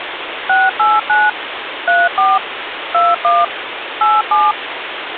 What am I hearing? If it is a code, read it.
DTMF, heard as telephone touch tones, dialled by machine, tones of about 200 ms, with phone line noise. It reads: 689 34 21 87